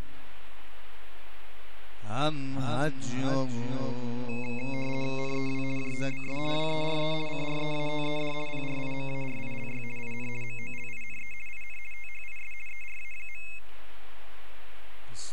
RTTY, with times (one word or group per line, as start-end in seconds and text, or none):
5.2-5.6 NEW
5.8-6.4 JOBS
6.5-7.1 WERE
7.3-8.3 CREATED
8.5-9.8 PRIMARILY
10.0-10.3 IN
10.4-11.3 MOLINE
11.5-11.8 IN
11.9-12.5 THIS
12.7-13.4 ERA.